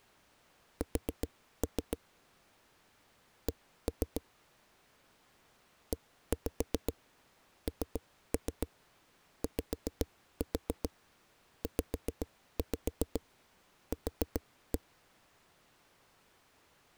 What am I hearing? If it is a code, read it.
Tap code, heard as knocks on a wall, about 7 knocks a second. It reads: S C ENYZQ